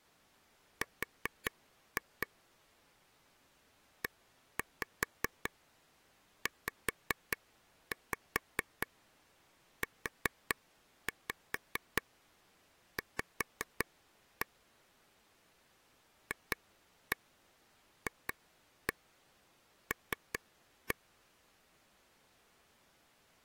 Tap code, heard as taps on a table, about 4 knocks a second. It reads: R EZUV FFL